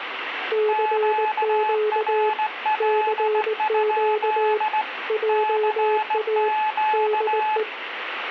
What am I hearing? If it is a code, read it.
Morse code, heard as two keyed tones, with radio static. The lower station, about 19 wpm, 420 Hz: CQ CQ JA DE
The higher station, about 16 wpm, 860 Hz: QRL? CQ